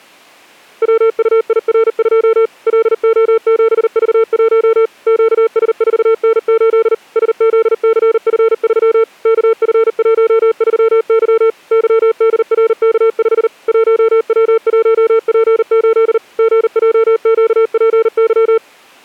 Morse code, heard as a keyed tone, machine-sent, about 39 wpm, 450 Hz. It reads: WUIR2 LO7V1 QS4N8 SZCF3 KF13Y YDRK5 1W1P8 GJQPY